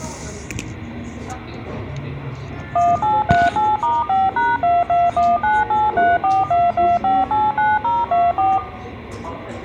DTMF, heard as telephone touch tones, dialled by machine, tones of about 200 ms, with a squelch burst at the end and the noise of a cafe. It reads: 1838*5#221983422589024